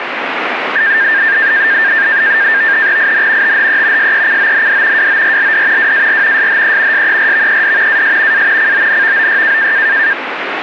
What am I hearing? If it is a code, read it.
NAVTEX (SITOR-B), 100 baud, 170 Hz shift, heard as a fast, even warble, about 1700 Hz centre, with radio static. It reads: IN THE SECOND WORLD WAR SHE SERVED AS A CONVOY